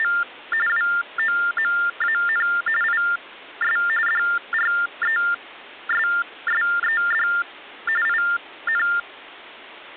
TTY/TDD text telephone tones (45.45 baud Baudot), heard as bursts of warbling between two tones, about 400 Hz shift, 1600 Hz centre. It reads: … WOMAN IS DRESSED IN